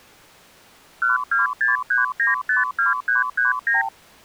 Multi-frequency trunk signalling (R2, with the far end's replies), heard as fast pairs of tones, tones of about 150 ms. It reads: 1263952339